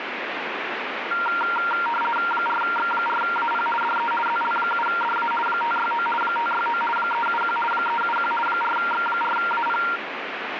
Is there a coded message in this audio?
Yes: RTTY (50 baud, 450 Hz shift) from 1.1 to 10.0 s, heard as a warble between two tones, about 1160 Hz centre, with radio static. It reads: 4X4AP DE ZL7DA 569 569 371 371 4X4AP